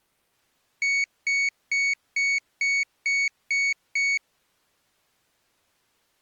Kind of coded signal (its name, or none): beep code